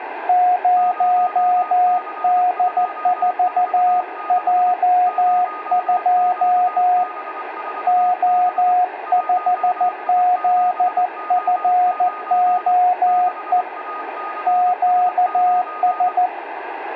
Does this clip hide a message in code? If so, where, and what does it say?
Yes: Morse code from 0.2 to 16.3 s, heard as two keyed tones, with radio static and room echo. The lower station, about 14 wpm, 720 Hz: 0D4J2 O5ZFOE QS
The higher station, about 24 wpm, 1240 Hz: 0C246 0QB4B 1I7O9 6ACS9